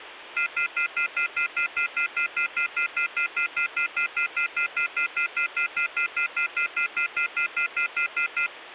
Telephone call progress tone (North American plan), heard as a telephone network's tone, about 1400, 2050, 2450, 2600 Hz, 0.1 s on and 0.1 s off, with phone line noise. Off-hook warning tone.